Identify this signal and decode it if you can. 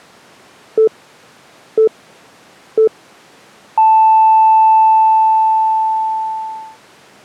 Radio time signal (three low pips and a long one an octave up, as on NHK), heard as pips.